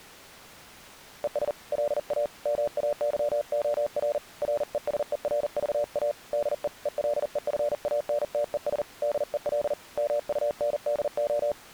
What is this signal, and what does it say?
Morse code, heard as a keyed tone, hand-sent with a paddle, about 40 wpm, 590 Hz. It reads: ES LA MAYOR RESERVA DE ELEFANTES DEL MUNDO